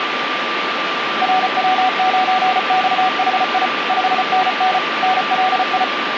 Morse code, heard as a keyed tone, machine-sent, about 34 wpm, 750 Hz, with radio static and a steady whistle near 1180 Hz. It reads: RW9XHI 5NN NLI